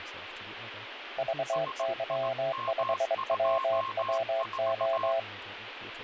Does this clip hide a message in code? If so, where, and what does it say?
Yes: Morse code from 1.1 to 5.3 s, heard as two keyed tones, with radio static and speech in English. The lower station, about 23 wpm, 670 Hz: VY5WWO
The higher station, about 18 wpm, 1070 Hz: SIM24